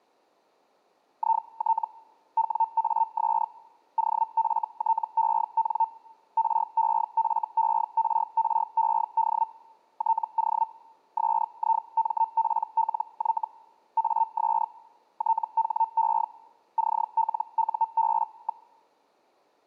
Hellschreiber (Feld-Hell, 122.5 baud), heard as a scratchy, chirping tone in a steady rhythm, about 900 Hz. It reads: IT WAS OFTEN REFERRED TO SIMPLY AS THE CLUB.